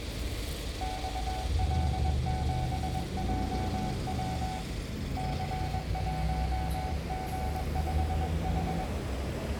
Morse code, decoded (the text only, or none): XL7JW C1G5H